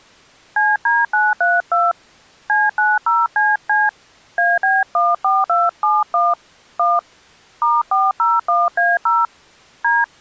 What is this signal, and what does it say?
DTMF, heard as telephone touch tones, dialled by hand, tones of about 200 ms. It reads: CD932 C90CC AB14271 1 *401A0 D